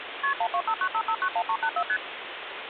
Multi-frequency trunk signalling (R1, as on North American trunks), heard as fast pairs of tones, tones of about 70 ms, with phone line noise. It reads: KP 12595591384 ST